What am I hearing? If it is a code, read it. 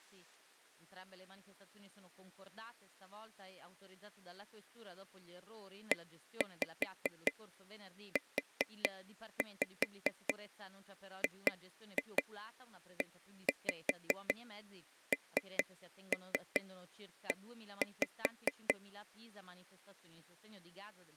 Tap code, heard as taps on a table, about 5 knocks a second, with speech in Italian. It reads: EUGENE